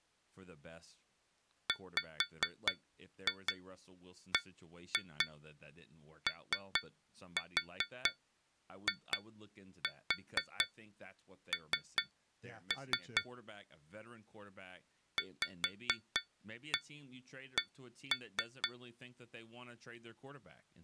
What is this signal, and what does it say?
Tap code, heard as taps on glass, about 4 knocks a second, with speech in English. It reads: WBOIN VC